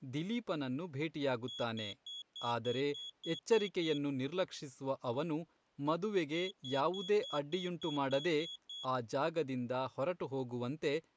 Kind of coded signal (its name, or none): beep code